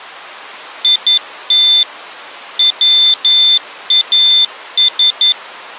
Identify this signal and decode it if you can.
Morse code, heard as a high beeper, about 11 wpm, 3550 Hz. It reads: IT WAS